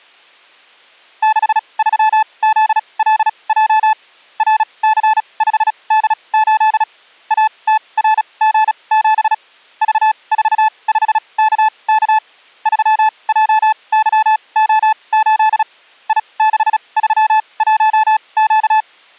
Morse code, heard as a keyed tone, machine-sent, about 36 wpm, spaced as for 26 wpm, 870 Hz. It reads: 63ZLJ RC5D8 ATRG7 V45KK 3JYO8 I631Q